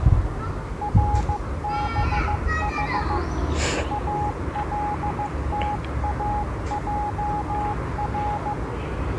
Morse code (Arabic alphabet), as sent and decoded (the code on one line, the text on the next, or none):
.-. -... .... / .- .-.. - .- .--- .-.
ربح التاجر